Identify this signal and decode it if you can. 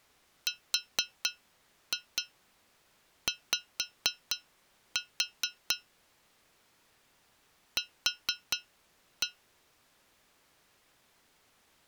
Tap code, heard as taps on a metal pipe, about 4 knocks a second. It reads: RY Q